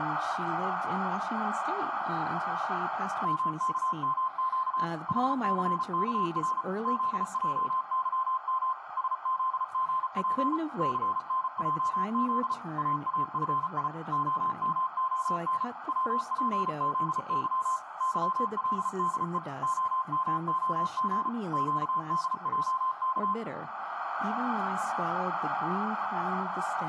Morse code, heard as a keyed tone, machine-sent, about 34 wpm, 1040 Hz, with radio static and speech in English. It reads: MKMQ HCKR ZJYM SZGP CNJZ AAFI OMON WPZY YLDE OMOG QDJK